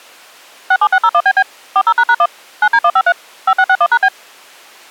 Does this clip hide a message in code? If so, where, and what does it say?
Yes: DTMF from 0.7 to 4.1 s, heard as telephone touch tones, dialled by machine, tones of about 60 ms. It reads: 67601BB 40##1 9D153 5661#B